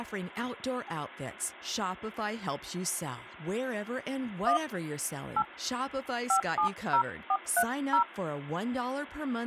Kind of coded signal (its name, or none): DTMF